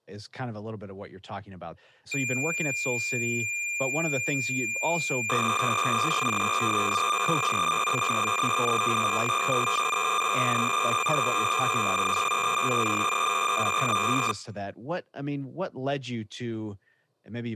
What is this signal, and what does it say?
Cassette data (Kansas City type), 300 baud, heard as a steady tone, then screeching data, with speech in English.